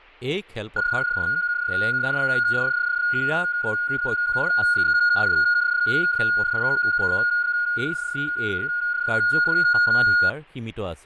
PSK31 (31.25 baud), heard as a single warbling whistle, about 1440 Hz, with fading and speech in Assamese.